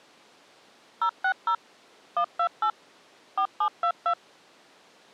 DTMF, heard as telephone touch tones, dialled by machine, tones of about 80 ms. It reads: 060 128 4722